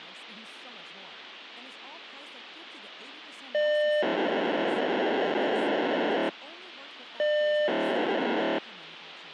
POCSAG pager data (1200 baud), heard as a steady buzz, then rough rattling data, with radio hiss and speech in Persian.